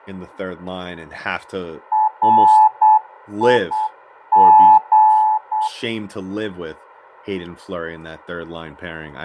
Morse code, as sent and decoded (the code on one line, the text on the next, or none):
.-. .. --.
RIG